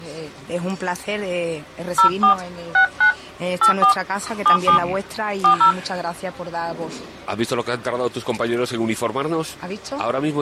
DTMF, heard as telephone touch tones, dialled by hand, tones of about 100 ms. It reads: 04 69 84 77 40